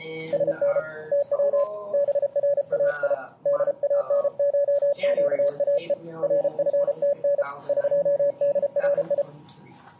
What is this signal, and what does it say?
Morse code (Persian alphabet), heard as a keyed tone, hand-sent with a paddle, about 33 wpm, 570 Hz. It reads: سن تو برای دانشگاه رفتن قدری